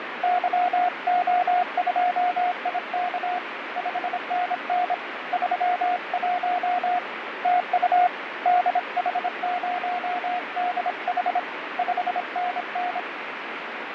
Morse code, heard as a keyed tone, hand-sent with a paddle, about 26 wpm, 720 Hz, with radio static and fading. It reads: YO2IK 5NN 31 TU DH0DH 5NN